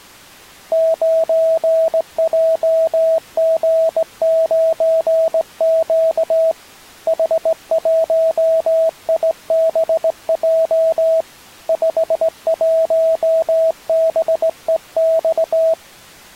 Morse code, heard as a keyed tone, hand-sent with a straight key, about 18 wpm, 650 Hz. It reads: 9JG9Q H1IBJ 51BEX